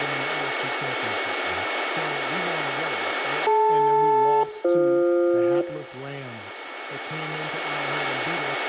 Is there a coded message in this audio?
Yes: aircraft SELCAL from 3.5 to 5.6 s, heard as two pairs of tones, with radio static, a steady whistle near 2210 Hz, room echo and speech in English. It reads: DL-BF